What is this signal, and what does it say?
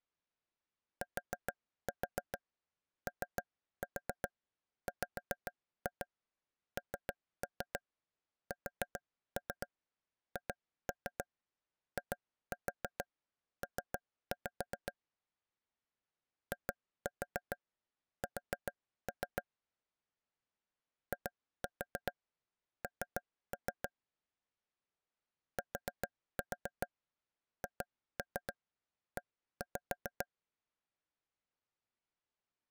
Tap code, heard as taps on a table, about 7 knocks a second. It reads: TOWNSHIP IS IN THE